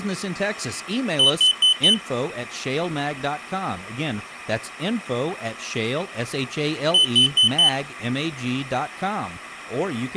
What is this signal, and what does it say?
Alarm pattern, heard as an alarm's beeps, played twice, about 3000 Hz, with speech in English. Temporal four. Carbon monoxide.